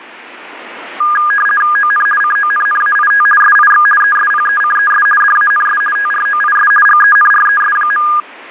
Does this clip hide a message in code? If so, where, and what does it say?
Yes: RTTY (50 baud, 450 Hz shift) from 1.0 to 8.2 s, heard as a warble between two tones, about 1430 Hz centre. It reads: ON CONNAIT SIX ESPECES DANS TROIS GENRES.